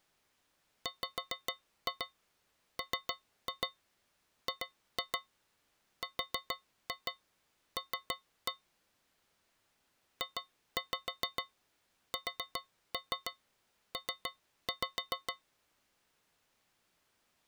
Tap code, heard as taps on a metal pipe, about 7 knocks a second. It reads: WMGRL JSP